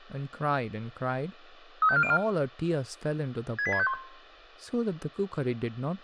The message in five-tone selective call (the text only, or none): 35404 68651